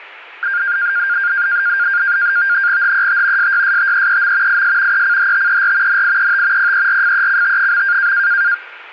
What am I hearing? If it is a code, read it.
NAVTEX (SITOR-B), 100 baud, 170 Hz shift, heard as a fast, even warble, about 1500 Hz centre. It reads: HET SYSTEEM IS ECHTER NIET PERFECT.